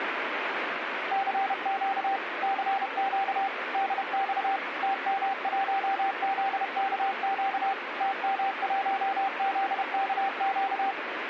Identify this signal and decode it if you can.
Morse code, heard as a keyed tone, machine-sent, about 31 wpm, 780 Hz, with radio static. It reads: CQ CQ DX TM1ZKQ TM1ZKQ